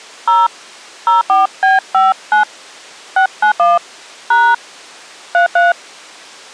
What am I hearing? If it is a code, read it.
DTMF, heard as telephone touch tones, dialled by hand, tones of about 170 ms. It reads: 0 04B59 691 # 33